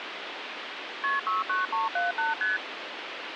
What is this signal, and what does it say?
Multi-frequency trunk signalling (R1, as on North American trunks), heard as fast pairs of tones, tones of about 160 ms, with phone line noise. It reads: KP 69378 ST